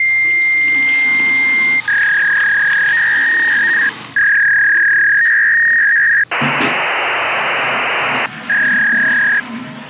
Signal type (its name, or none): fax machine handshake